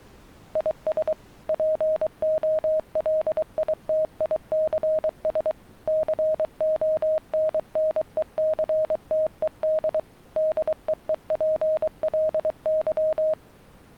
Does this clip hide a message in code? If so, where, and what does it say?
Yes: Morse code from 0.5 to 13.4 s, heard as a keyed tone, machine-sent, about 23 wpm, 630 Hz. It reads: IS POLITICS CONNECTED DEEPLY